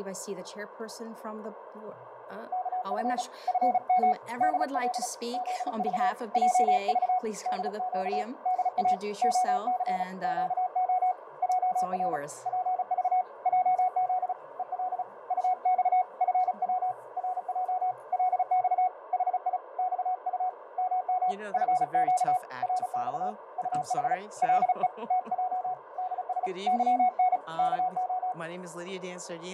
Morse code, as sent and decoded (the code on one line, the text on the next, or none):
-.- ..-. / ..-. -- / -.. .-.. / --.. ...- / .--- ...- / -.. --.- / -.. .- / --- -.-. / --.- --- / .--- .-. / .--. ...- / .--- --.. / . .-.. / ..- -..- / ..-. .-- / .-. .--- / .-.. -..- / .... .. / -..- ..- / -- -- / ..-. --.- / .-. -..- / ..- .... / .-.. . / - .--- / -.. ... / -.-- -. / -.- ---
KF FM DL ZV JV DQ DA OC QO JR PV JZ EL UX FW RJ LX HI XU MM FQ RX UH LE TJ DS YN KO